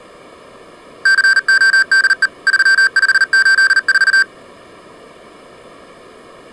Morse code, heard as electronic beeps, machine-sent, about 39 wpm, 1550 Hz. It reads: CODE 3584